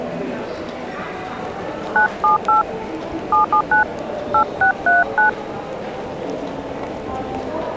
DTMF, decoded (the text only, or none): 978 779 8639